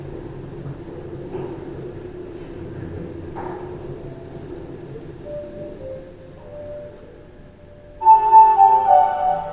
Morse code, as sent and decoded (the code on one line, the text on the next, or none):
none